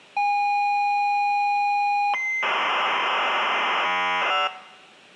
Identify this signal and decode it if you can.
ZX Spectrum tape loading, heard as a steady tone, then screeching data, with room echo.